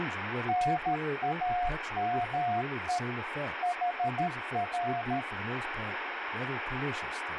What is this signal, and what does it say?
Morse code, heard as a keyed tone, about 13 wpm, 710 Hz, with radio static and speech in English. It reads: NAME HR